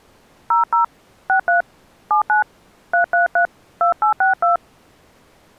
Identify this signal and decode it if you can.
DTMF, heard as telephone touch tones, dialled by hand, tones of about 120 ms. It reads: 00 63 79 333 2862